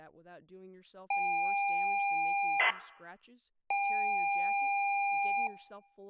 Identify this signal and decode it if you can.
ZX Spectrum tape loading, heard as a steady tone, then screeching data, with speech in English.